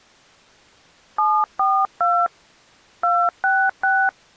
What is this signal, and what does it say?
DTMF, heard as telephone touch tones, dialled by hand, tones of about 260 ms. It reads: 742 266